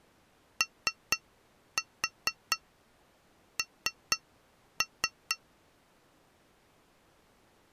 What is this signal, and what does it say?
Tap code, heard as taps on glass, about 4 knocks a second. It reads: ON